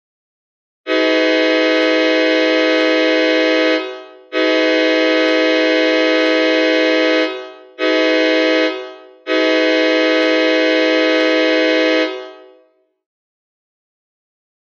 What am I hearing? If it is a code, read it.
Train horn signal, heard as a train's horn, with room echo. 2 long, 1 short, 1 long. On North American railways: approaching a public crossing.